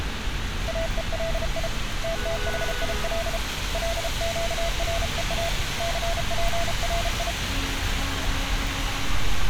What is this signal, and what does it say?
Morse code (Hebrew alphabet), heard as a keyed tone, hand-sent with a paddle, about 33 wpm, 670 Hz, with street noise. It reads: אולי תתחיל לקרוא ספרי